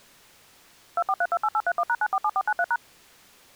DTMF, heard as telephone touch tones, dialled by machine, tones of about 50 ms. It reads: 24328831#947493#